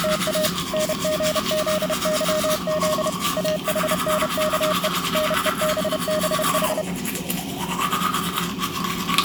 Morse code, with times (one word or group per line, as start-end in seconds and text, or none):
0.0-0.5 …
0.7-3.1 NGZYZ
3.4-4.9 AHNKE
5.1-6.8 NEBBH